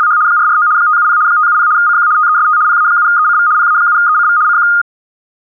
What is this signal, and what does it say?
RTTY (75 baud, 170 Hz shift), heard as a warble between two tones, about 1330 Hz centre. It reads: … 449 570 570 CQ TEST PA7ECV PA7ECV CQ